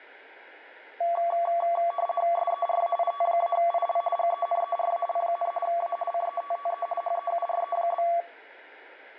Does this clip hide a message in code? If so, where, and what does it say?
Yes: RTTY (50 baud, 450 Hz shift) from 1.0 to 8.2 s, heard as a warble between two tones, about 910 Hz centre. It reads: SERAIT-IL GENERAL, A CETTE HEURE?